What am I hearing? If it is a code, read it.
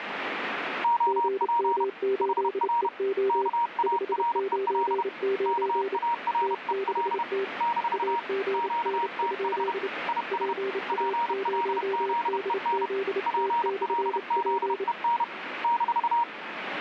Morse code, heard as two keyed tones, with radio static. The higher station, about 31 wpm, 940 Hz: OP HR KAREL KAREL - QTH IS PLZEN PLZEN -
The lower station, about 28 wpm, 390 Hz: GM8EO 599 T6T AGN? PA0DZT/P